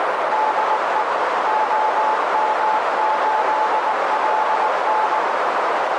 Morse code, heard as a keyed tone, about 19 wpm, 860 Hz, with heavy radio static and a narrow filter. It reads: DE OM8LN